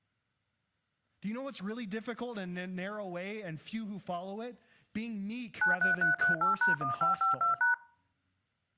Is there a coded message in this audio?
Yes: DTMF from 5.6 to 7.7 s, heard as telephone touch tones, dialled by machine, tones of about 130 ms, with speech in English. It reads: 93338#1552#